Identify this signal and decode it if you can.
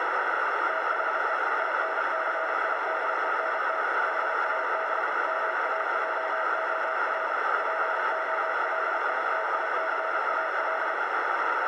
Morse code, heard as a keyed tone, machine-sent, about 32 wpm, 650 Hz, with heavy radio static and a narrow filter. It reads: THE INCIDENT HAD MAJOR POLITICAL